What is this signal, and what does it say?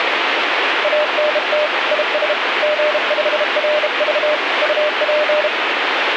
Morse code, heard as a keyed tone, hand-sent with a bug key, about 32 wpm, 600 Hz, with radio static. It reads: ANT IS G5RV UP